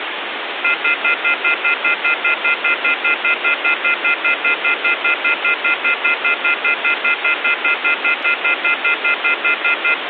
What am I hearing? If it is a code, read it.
Telephone call progress tone (North American plan), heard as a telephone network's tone, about 1400, 2050, 2450, 2600 Hz, 0.1 s on and 0.1 s off, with phone line noise. Off-hook warning tone.